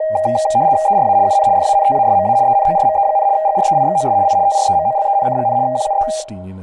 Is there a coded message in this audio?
Yes: RTTY (75 baud, 170 Hz shift) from 0.0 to 6.2 s, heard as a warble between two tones, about 710 Hz centre, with room echo and speech in English. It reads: ERA UN FANTASMA ENORME, GREIXOS I TREMOLENC, QUE